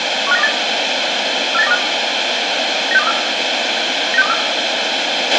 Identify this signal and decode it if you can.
Five-tone selective call (EEA), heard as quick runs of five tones, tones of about 40 ms, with radio hiss, a squelch burst at the end and room echo. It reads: 15928 48925 96234 96234